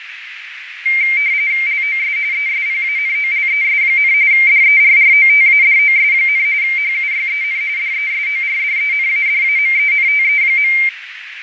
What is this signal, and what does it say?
RTTY (45.45 baud, 170 Hz shift), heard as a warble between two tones, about 2200 Hz centre, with radio static, fading and a narrow filter. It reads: LOS ESPANOLES, DERROTADOS, HUYEN DESORDENADAMENTE.